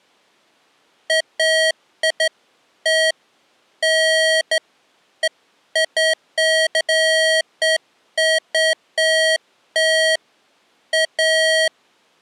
Beeps of irregular length. There is no code.